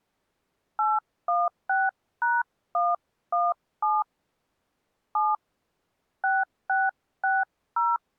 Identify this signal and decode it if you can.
DTMF, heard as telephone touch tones, dialled by hand, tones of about 200 ms. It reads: 816#117 7 6660